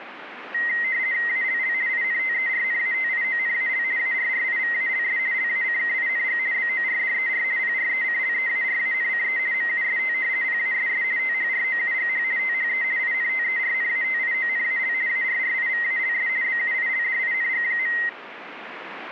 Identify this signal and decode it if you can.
RTTY (50 baud, 170 Hz shift), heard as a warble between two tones, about 2000 Hz centre, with radio static. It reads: ALL INTERNATIONAL ARRIVALS LACKING BORDER PRECLEARANCE MUST PASS THROUGH THE INTERNATIONAL ARRIVALS BUILDING.